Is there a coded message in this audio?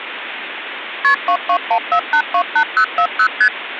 Yes: multi-frequency trunk signalling (R1, as on North American trunks) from 1.0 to 3.5 s, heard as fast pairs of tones, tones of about 80 ms, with phone line noise. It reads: KP 2214828040 ST